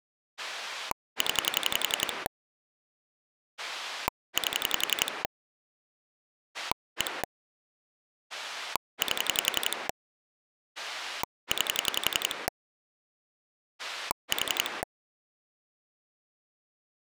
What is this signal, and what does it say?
Pulse dialling, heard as a rotary dial, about 11 pulses a second. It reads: 0 8 1 8 9 4